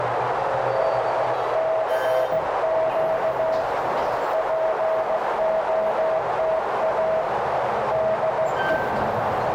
Morse code, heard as a keyed tone, hand-sent with a straight key, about 16 wpm, 640 Hz, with heavy radio static, a narrow filter and the noise inside a lift. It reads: CQ POTA DE